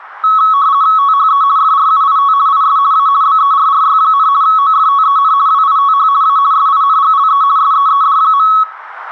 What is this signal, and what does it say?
RTTY (50 baud, 170 Hz shift), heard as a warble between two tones, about 1200 Hz centre. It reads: THE FRUIT IS A BERRY, OFTEN WITH A SINGLE SEED.